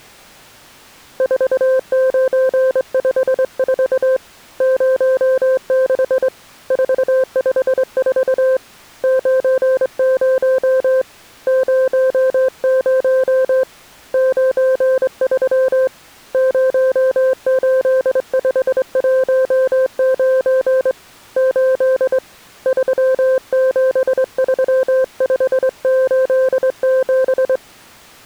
Morse code, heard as a keyed tone, hand-sent with a straight key, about 23 wpm, 520 Hz. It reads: 4954 06 454 90 00 93 08519 8 373587